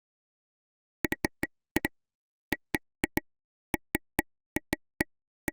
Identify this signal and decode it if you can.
Irregular taps on a table. There is no code.